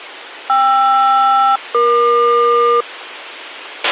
Aircraft SELCAL, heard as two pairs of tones, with a squelch burst at the end. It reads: KR-EQ